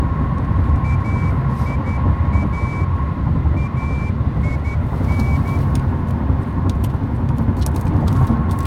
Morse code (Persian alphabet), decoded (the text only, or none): ایا این